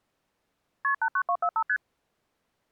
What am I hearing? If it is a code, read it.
Multi-frequency trunk signalling (R1, as on North American trunks), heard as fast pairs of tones, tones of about 70 ms. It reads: KP 89245 ST